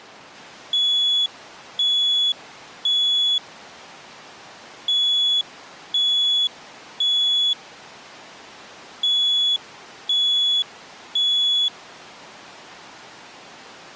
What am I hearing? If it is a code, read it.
Alarm pattern, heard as an alarm's beeps, played three times, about 3400 Hz. Temporal three. Smoke or fire, evacuate.